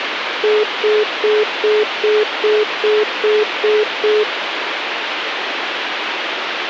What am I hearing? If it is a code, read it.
Telephone call progress tone (single-tone plan, as in most of Europe), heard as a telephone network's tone, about 420 Hz, 0.2 s on and 0.2 s off, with phone line noise. Congestion tone.